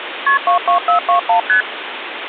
Multi-frequency trunk signalling (R1, as on North American trunks), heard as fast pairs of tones, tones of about 110 ms, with phone line noise. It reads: KP 22421 ST